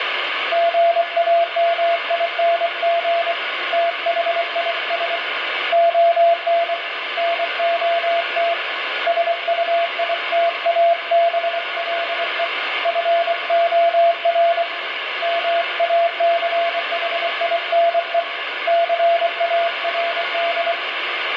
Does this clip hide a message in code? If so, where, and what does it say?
Yes: Morse code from 0.5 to 20.8 s, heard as a keyed tone, hand-sent with a paddle, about 24 wpm, 680 Hz, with radio static and room echo. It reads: GAMING THIS ON NOT SUITABLE FOR MACHINE CARD